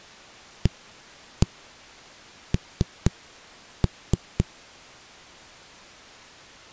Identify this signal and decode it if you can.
Tap code, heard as knocks on a wall, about 4 knocks a second. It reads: AN